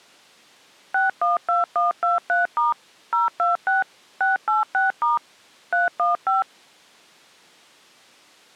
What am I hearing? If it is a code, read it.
DTMF, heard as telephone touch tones, dialled by machine, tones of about 150 ms. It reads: 612123* 026 686* 315